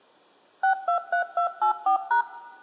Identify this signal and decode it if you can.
DTMF, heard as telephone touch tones, dialled by machine, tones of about 100 ms, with room echo. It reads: 623284#